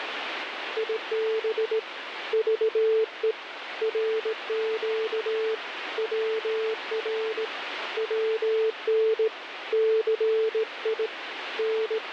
Morse code, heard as a keyed tone, hand-sent with a straight key, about 18 wpm, 440 Hz, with radio static. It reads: IB VE RQ WR WN CI …